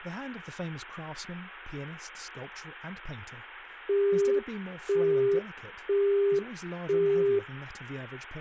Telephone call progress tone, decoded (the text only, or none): busy tone